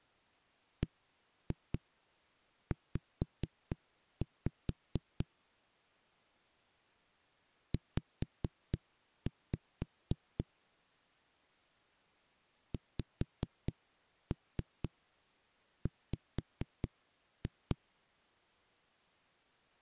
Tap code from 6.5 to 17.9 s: Z XW

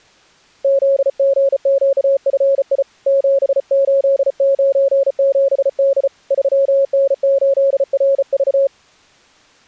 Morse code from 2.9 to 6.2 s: 7897D

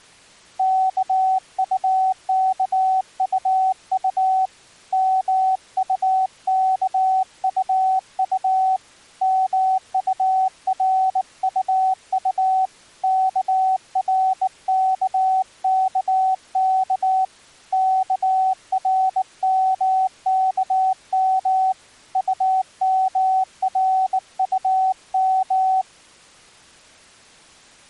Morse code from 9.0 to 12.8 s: MURUU

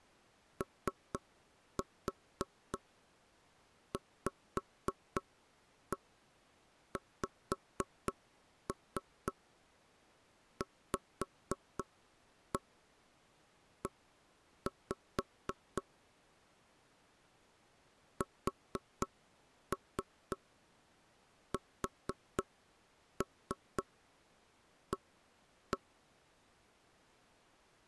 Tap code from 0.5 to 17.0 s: OVXVE

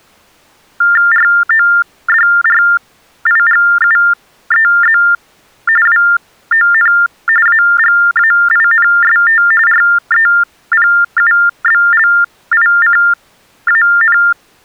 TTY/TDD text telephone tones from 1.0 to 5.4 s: RODRIGUEZ

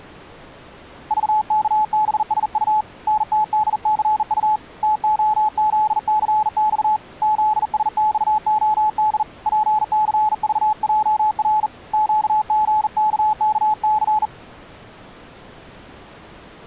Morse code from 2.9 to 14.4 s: NTDCU TOZCX ZSXOD PCVJR QGKKC

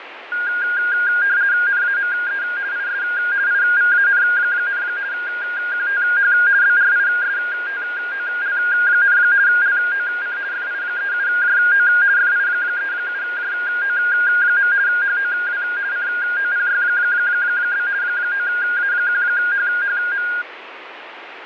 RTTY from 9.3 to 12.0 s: LOC FI37JO

